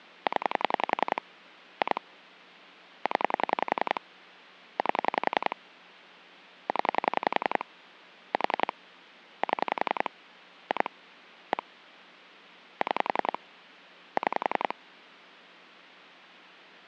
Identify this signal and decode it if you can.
Pulse dialling, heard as clicks on a phone line, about 10 pulses a second. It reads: 0 2 0 8 0 4 7 2 1 6 6